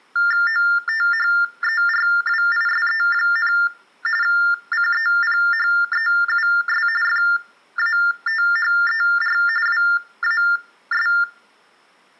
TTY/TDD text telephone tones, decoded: OTHERWISE, CEPHEUS FATHER WAS

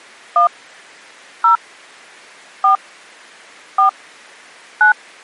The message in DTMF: 1 0 4 4 9

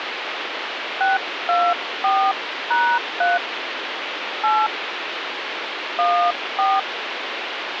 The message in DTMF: 624#3 8 14

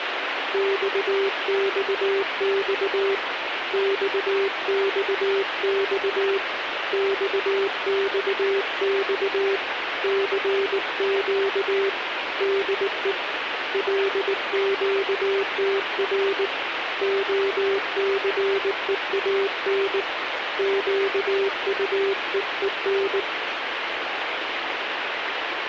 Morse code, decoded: XXX XXX XXX CQ DE LQTR OCEAN QUEEN

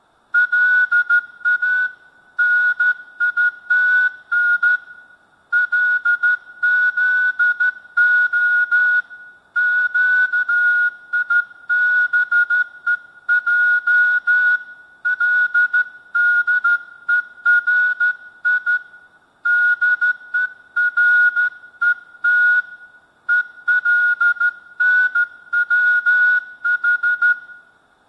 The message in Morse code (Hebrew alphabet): לא ניתן לזה קיבוע לדורי דורות ולנצח

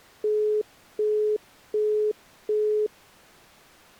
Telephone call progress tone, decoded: busy tone

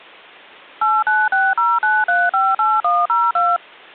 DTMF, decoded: 89609358102

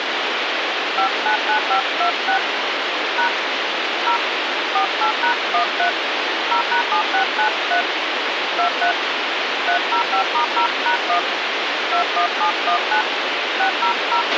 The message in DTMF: 599526 # 0 48#13 0#7693 23 305*0#1 21719 600

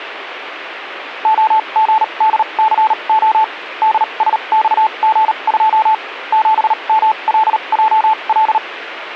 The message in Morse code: OGDCO DSXG2 7MLJL

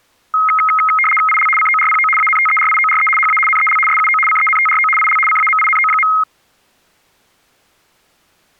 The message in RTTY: IL CORPO ANTERIORE HA NEL SUO CENTRO IL CAMINO.

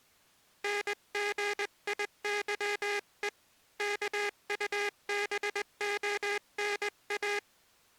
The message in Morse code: NGIYE KUBONA

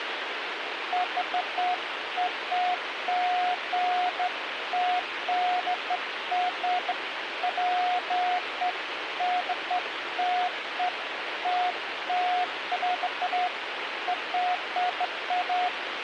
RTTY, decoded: none

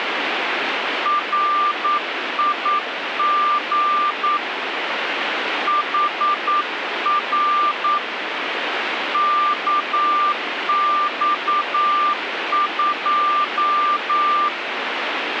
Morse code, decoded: RIG HR KX2

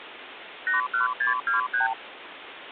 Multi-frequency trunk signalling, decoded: 81623

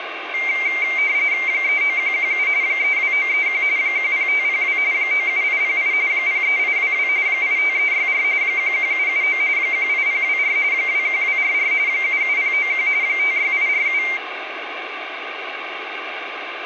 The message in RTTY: 39117 32931 10502 97808 03822 85364 11779 18024 21244 77091 56847

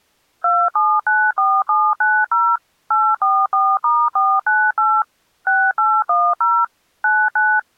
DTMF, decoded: 2794790 844*498 6810 99

